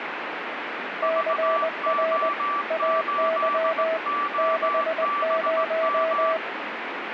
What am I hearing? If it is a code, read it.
Morse code, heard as two keyed tones, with radio static. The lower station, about 20 wpm, 650 Hz: CR AY 60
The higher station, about 18 wpm, 1160 Hz: VO8OBM